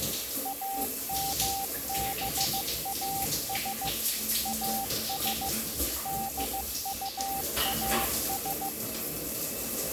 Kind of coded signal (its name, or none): Morse code